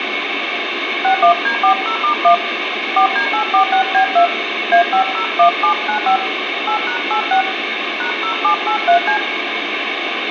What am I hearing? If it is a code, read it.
DTMF, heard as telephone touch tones, dialled by hand, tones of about 100 ms, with radio hiss and room echo. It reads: 61D40*1 4D846B2 A501795 8#86 #0783C